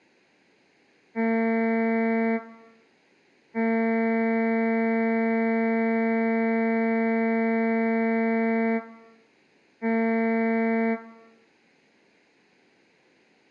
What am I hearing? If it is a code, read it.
Ship horn signal, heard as a ship's horn, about 230 Hz, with room echo. 1 short, 1 long, 1 short. At sea: a vessel at anchor warns of its position.